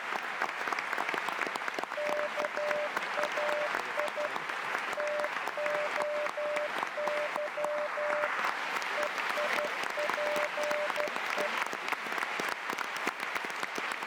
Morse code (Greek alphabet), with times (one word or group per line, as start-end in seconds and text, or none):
2.0-4.3 ΚΑΙ
5.0-8.3 ΤΟΥ
9.0-11.5 ΕΙΠΕ